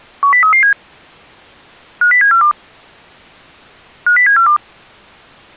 Five-tone selective call (CCIR), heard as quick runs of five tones, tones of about 100 ms. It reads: 10337 50742 50742